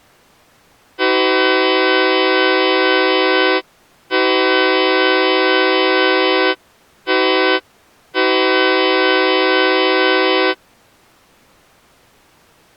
Train horn signal, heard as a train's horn. 2 long, 1 short, 1 long. On North American railways: approaching a public crossing.